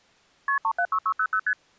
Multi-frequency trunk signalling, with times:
0.5-0.6 KP
0.6-1.4 376600
1.5-1.5 ST

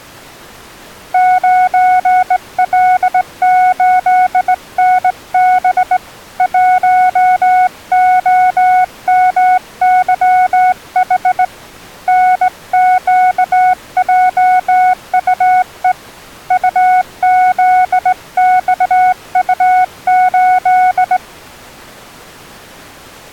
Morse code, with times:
1.1-6.0 9L8NB
6.4-11.4 1OMYH
12.1-15.9 NQJUE
16.5-21.2 UZXU8

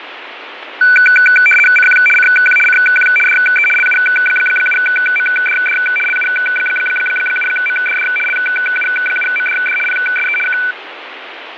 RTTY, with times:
1.8-2.0 CQ
2.2-2.6 CQ
2.7-3.1 CQ
3.3-3.7 DE
3.8-5.8 LU7MDD
6.1-8.1 LU7MDD
8.3-9.8 LU7MDD
9.9-10.4 PSE
10.5-10.6 K

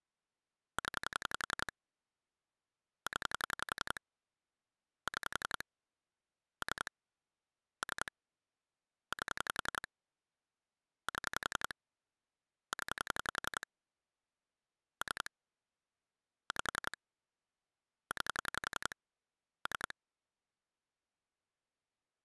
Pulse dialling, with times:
0.8-1.7 0
3.1-4.0 0
5.1-5.6 6
6.6-6.9 3
7.8-8.1 3
9.1-9.9 8
11.1-11.7 7
12.7-13.7 0
15.0-15.3 3
16.5-17.0 5
18.1-18.9 9
19.7-19.9 3

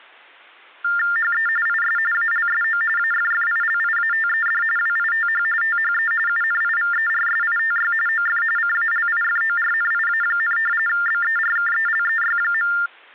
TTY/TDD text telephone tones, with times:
1.2-1.5 HE
1.7-2.0 IS
2.1-2.8 ALSO
3.0-4.6 AFFILIATED
4.8-5.4 WITH
5.6-6.1 THE
6.3-7.9 UNIVERSITY
8.1-8.4 OF
8.6-10.6 CALIFORNIA,
10.9-12.7 BERKELEY.

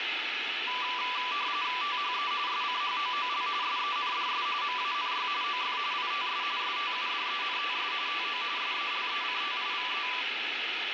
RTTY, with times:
1.8-2.3 THE
2.5-3.5 SCHOOL
3.6-4.5 SENDS
4.6-5.3 MANY
5.4-5.8 OF
5.9-6.4 ITS
6.6-7.9 STUDENTS
8.1-8.4 TO
8.6-10.1 SELECTIVE

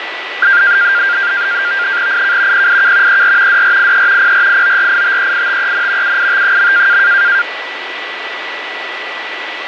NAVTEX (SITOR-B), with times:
2.1-2.7 IK
2.5-3.2 PIK
3.1-3.6 ER
3.5-4.3 DRIE
4.2-6.2 PRIORITEITEN
6.0-7.0 UIT.

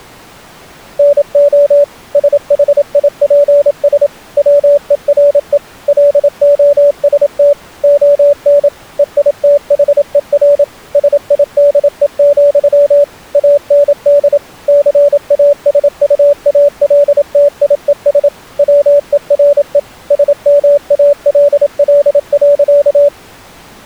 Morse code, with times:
1.0-1.8 NO
2.2-4.1 SHIPS
4.4-5.6 WERE
5.9-7.5 LOST
7.8-8.7 ON
9.0-10.6 EITHER
11.0-13.0 SIDE,
13.4-14.4 AND
14.7-18.3 CASUALTIES
18.6-19.8 WERE
20.1-23.1 SMALL.

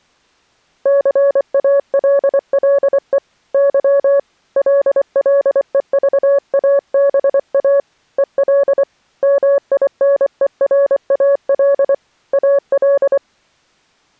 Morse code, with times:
0.9-3.2 CALLE
3.5-4.2 Y
4.6-7.8 LLEVABA
8.2-8.8 EL
9.2-11.9 MINERAL
12.3-13.2 AL

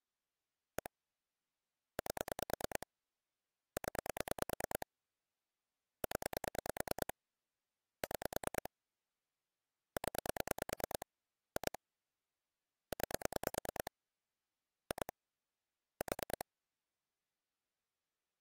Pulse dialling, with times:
0.8-0.9 1
2.0-2.9 8
3.8-4.9 0
6.0-7.1 0
8.0-8.7 6
10.0-11.1 0
11.6-11.8 2
12.9-13.9 9
14.9-15.1 2
16.0-16.4 4

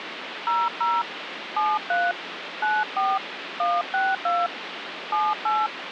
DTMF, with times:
0.5-1.0 00
1.6-2.1 73
2.6-3.2 94
3.6-4.5 162
5.1-5.7 78

